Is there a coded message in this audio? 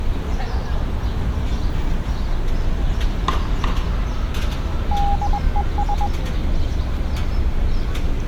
Yes: Morse code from 4.9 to 6.1 s, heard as a keyed tone, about 21 wpm, 810 Hz, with street noise. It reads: DES